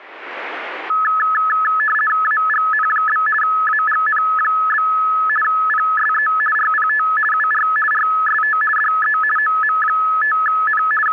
RTTY (50 baud, 450 Hz shift), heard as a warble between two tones, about 1500 Hz centre. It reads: AGN? AGN? PSE RPT UR RST DE OM5N …